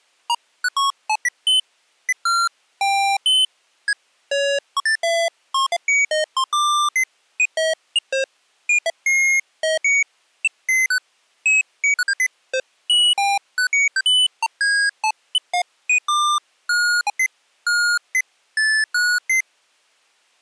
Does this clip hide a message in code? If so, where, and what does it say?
No, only electronic bleeps of random pitch and length.